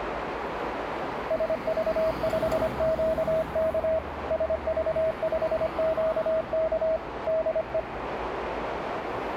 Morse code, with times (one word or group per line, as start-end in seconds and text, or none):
1.3-4.0 SV5QK
4.3-7.0 SV5QK
7.3-7.8 DE